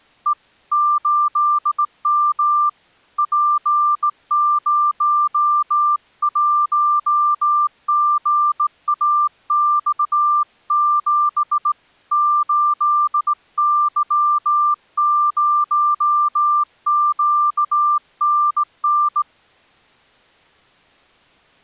Morse code, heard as a keyed tone, hand-sent with a straight key, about 18 wpm, 1190 Hz. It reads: E 8M P01GAX7 8Y0QNN